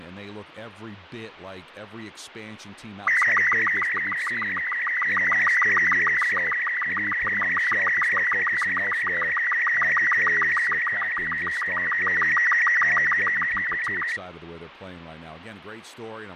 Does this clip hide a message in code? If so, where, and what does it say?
Yes: SSTV (slow-scan television), Robot 36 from 3.1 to 14.2 s, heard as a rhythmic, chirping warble, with radio static and speech in English.